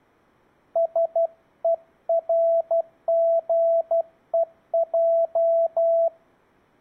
Morse code (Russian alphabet), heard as a keyed tone, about 12 wpm, 670 Hz. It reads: СЕРГЕЙ